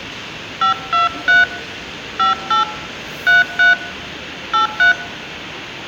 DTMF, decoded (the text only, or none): 523 58 33 83